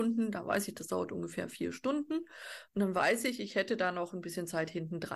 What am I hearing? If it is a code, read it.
Speech in German. There is no code.